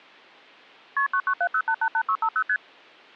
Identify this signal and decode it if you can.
Multi-frequency trunk signalling (R1, as on North American trunks), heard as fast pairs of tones, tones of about 70 ms. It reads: KP 9970888650 ST